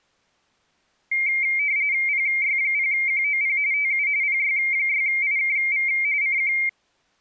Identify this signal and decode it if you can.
RTTY (45.45 baud, 170 Hz shift), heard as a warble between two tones, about 2200 Hz centre. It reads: PY0QOP TU PY6IKV CQ